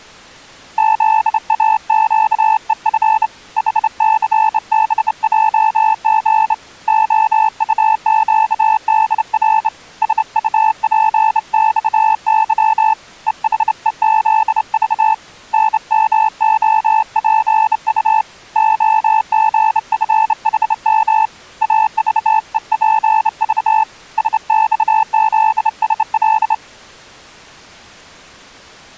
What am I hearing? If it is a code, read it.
Morse code, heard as a keyed tone, hand-sent with a straight key, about 28 wpm, 880 Hz. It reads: ZAQEF HCBJG OUQDR SUPXY EHEZV NMOPU OGFHM AVEPV SXZSL